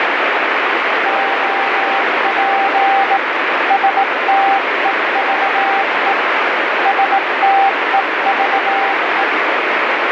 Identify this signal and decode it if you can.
Morse code, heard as a keyed tone, hand-sent with a bug key, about 18 wpm, 790 Hz, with heavy radio static. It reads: OP STEVE STEVE